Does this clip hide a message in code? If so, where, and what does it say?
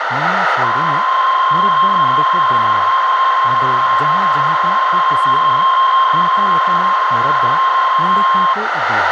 Yes: PSK63 (62.5 baud) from 0.6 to 8.5 s, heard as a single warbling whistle, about 1060 Hz, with radio static, a narrow filter and speech in Santali.